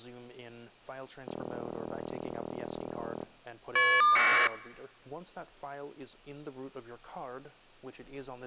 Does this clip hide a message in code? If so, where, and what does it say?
Yes: caller ID data burst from 1.3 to 4.5 s, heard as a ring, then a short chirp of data, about 1200 baud.